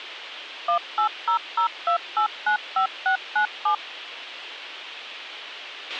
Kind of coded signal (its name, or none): DTMF